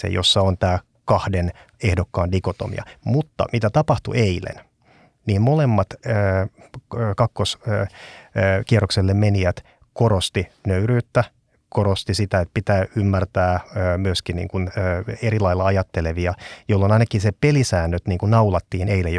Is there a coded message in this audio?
No, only speech in Finnish.